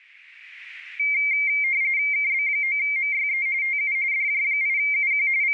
RTTY (45.45 baud, 170 Hz shift), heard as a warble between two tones, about 2200 Hz centre. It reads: KB9MYE TU DJ8UQ …